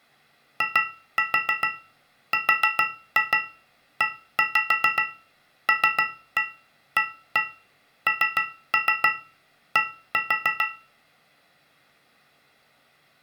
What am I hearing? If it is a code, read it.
Tap code, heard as taps on a metal pipe, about 6 knocks a second, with room echo. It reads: IRELAND